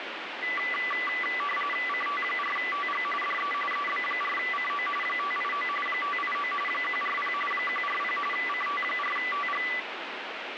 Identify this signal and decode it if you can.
RTTY (45.45 baud, 850 Hz shift), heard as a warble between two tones, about 1600 Hz centre, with radio static. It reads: CT4TG DE EB4CO 589 589 140 140 CT4TG